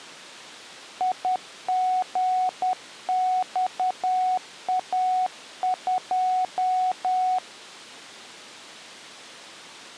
Morse code, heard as a keyed tone, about 10 wpm, 740 Hz. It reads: IGXA2